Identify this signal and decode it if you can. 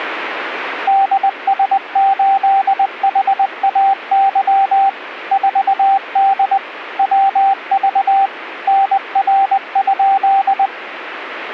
Morse code, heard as a keyed tone, machine-sent, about 20 wpm, 780 Hz. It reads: DS8HAY 4D WV NR?